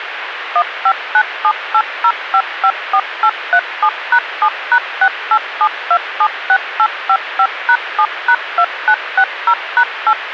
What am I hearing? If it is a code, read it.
DTMF, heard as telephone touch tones, dialled by machine, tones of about 70 ms, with radio hiss. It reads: 159780554837#7#687276855#7#2960#8